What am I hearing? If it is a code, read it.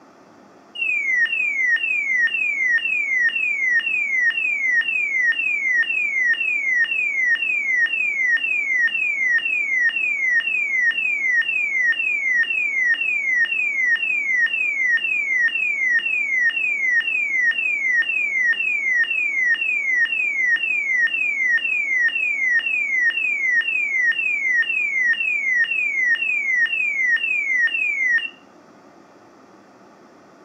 A tone that sweeps in pitch again and again, with room echo. There is no code.